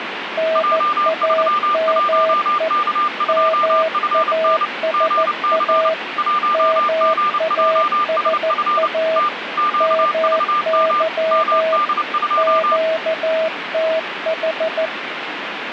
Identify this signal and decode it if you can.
Morse code, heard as two keyed tones, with radio static. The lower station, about 14 wpm, 640 Hz: NAME MASA MASA MY QTH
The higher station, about 29 wpm, 1200 Hz: J31K2FN GC 1GJSF T QVM MD2